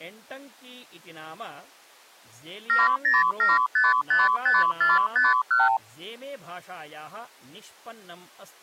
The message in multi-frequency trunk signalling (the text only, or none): 707555451